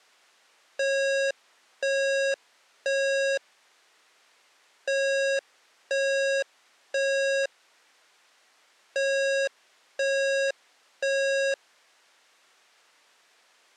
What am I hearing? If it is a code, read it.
Alarm pattern, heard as an alarm's beeps, played three times, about 550 Hz. Temporal three. Smoke or fire, evacuate.